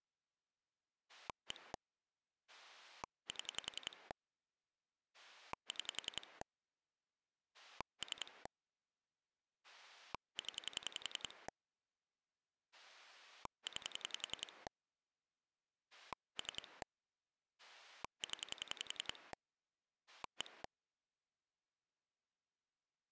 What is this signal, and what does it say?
Pulse dialling, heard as a rotary dial, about 10 pulses a second. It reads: 1 7 6 3 0 9 3 0 1